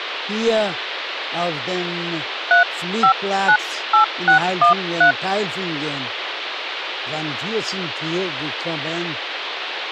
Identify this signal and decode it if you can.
DTMF, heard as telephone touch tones, dialled by hand, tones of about 110 ms, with phone line noise. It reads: 3598613